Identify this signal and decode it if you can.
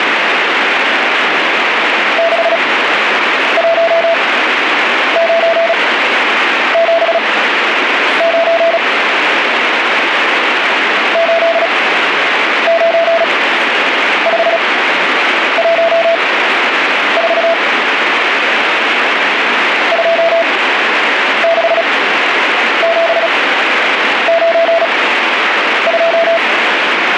Morse code, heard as a keyed tone, machine-sent, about 36 wpm, spaced as for 8 wpm, 670 Hz, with radio static and speech in English. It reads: 61979 89514 26792